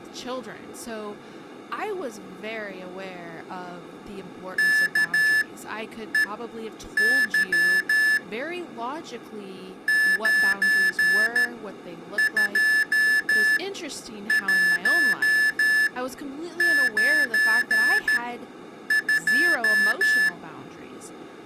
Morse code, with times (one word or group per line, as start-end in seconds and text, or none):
4.6-8.2 KEY
9.9-20.3 92192